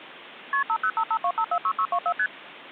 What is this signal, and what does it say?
Multi-frequency trunk signalling (R1, as on North American trunks), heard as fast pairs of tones, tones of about 70 ms. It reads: KP 50552546624 ST